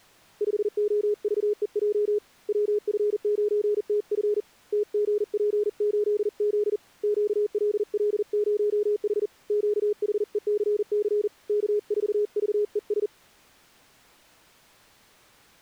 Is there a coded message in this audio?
Yes: Morse code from 0.4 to 13.1 s, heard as a keyed tone, hand-sent with a paddle, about 40 wpm, 420 Hz. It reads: 5OVEJ WF9TF TGP8Z QLL0H QHECC K4VES